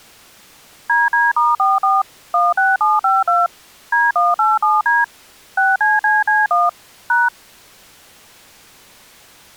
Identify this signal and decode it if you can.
DTMF, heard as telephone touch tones, dialled by machine, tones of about 190 ms. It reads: DD*44 16752 D187D 6CCC1 #